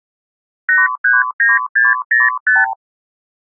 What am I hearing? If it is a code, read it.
Multi-frequency trunk signalling (R2, with the far end's replies), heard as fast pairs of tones, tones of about 180 ms. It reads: 839605